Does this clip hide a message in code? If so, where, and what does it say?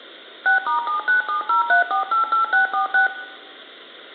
Yes: DTMF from 0.5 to 3.1 s, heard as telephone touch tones, dialled by machine, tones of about 120 ms, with room echo. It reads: 6*79703488646